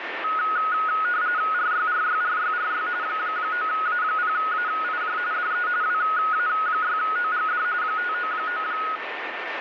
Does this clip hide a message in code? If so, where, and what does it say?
Yes: RTTY (45.45 baud, 170 Hz shift) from 0.2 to 9.0 s, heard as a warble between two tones, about 1360 Hz centre, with radio static and a steady whistle near 1800 Hz. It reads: RYRYRYRY 9A0AIJ DE WA6OGD 599